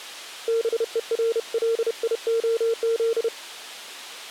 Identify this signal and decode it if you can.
Morse code, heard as a keyed tone, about 31 wpm, 460 Hz. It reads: BERLIOZ